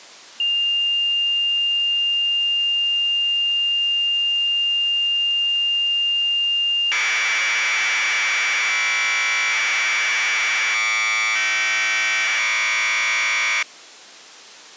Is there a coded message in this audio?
Yes: Commodore tape loading (standard loader) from 0.4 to 13.6 s, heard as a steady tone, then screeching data.